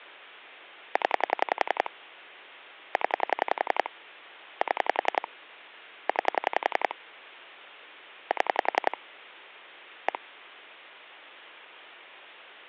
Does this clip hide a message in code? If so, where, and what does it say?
Yes: pulse dialling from 1.0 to 10.2 s, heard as clicks on a phone line, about 11 pulses a second. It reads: 0 0 7 9 7 1